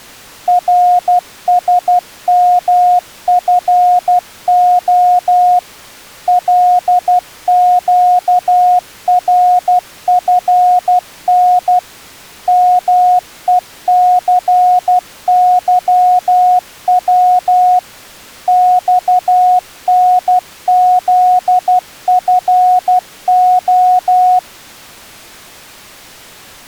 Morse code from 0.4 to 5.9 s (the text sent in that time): RSMFO